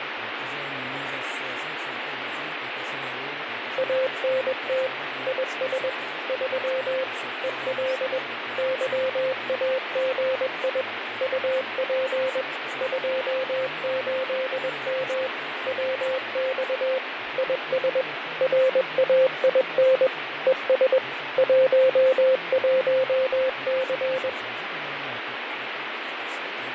Morse code, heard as a keyed tone, machine-sent, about 21 wpm, 520 Hz, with radio static and fading. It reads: ANT IS 3 EL YAGI UP 28M WX IS RAIN ES 11C